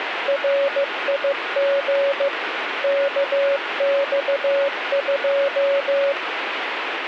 Morse code, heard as a keyed tone, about 15 wpm, 560 Hz, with radio static. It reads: RIG KX2